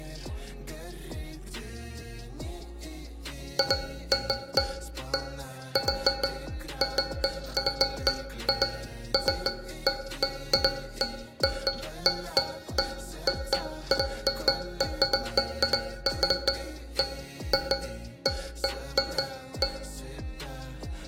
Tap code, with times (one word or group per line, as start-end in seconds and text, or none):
none